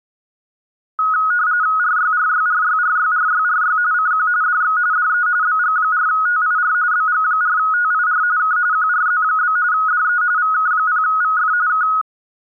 RTTY (45.45 baud, 170 Hz shift), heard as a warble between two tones, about 1360 Hz centre. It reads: RYRYRYRYRYRY CQ DX DE BG4TIR BG4TIR K QRZ? DE VK0VF K